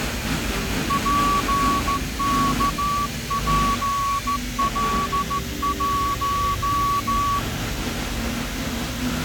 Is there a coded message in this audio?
Yes: Morse code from 0.8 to 7.5 s, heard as a whistle, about 14 wpm, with the noise of a cafe. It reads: PKPL1